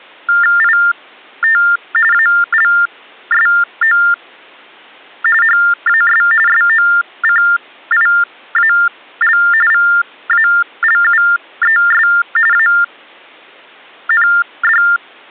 TTY/TDD text telephone tones (45.45 baud Baudot), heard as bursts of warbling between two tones, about 400 Hz shift, 1600 Hz centre. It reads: IT ALSO HAS SOCIAL VALUES AND